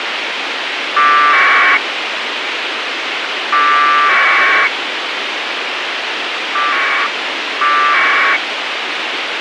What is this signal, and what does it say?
Packet radio (AX.25, as in APRS), 1200 baud, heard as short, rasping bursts, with radio hiss.